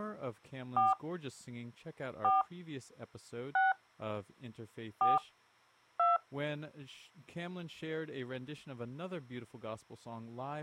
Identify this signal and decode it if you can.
DTMF, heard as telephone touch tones, dialled by hand, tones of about 170 ms, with speech in English. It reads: 4 4 6 4 2